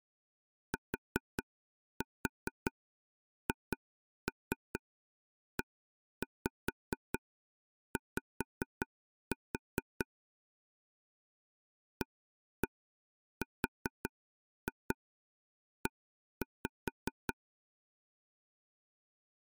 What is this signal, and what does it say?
Tap code, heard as taps on a table, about 4 knocks a second. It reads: THEY ARE